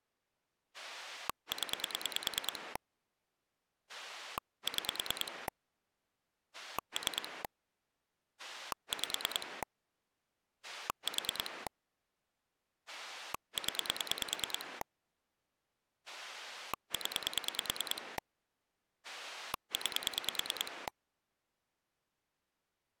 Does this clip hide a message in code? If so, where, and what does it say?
Yes: pulse dialling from 0.7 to 20.9 s, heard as a rotary dial, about 9 pulses a second. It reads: 0 6 3 5 4 0 0 9